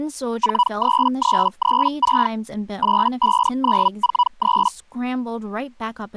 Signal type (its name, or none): Hellschreiber